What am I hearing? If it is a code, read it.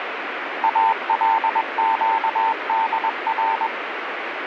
Morse code (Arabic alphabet), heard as a keyed tone, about 21 wpm, 900 Hz, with radio static. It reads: القدر